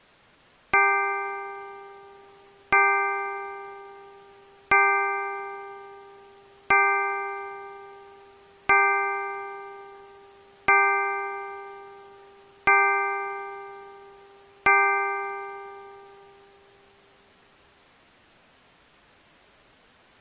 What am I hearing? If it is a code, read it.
Clock strike, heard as a bell. 8. Eight o'clock.